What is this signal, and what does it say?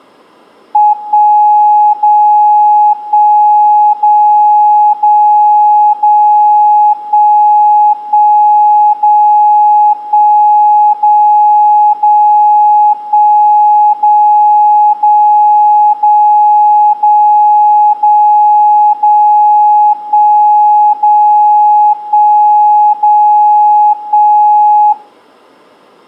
Radio time signal (DCF77), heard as a tone whose level steps once a second, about 840 Hz. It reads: 1 0 1 0 0 0 1 1 0 1 0 0 1 0 0 0 0 0 0 1 0 1 0 1